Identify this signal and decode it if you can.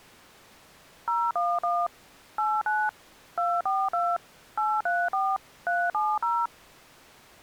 DTMF, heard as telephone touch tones, dialled by machine, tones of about 230 ms. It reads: 011 89 242 834 370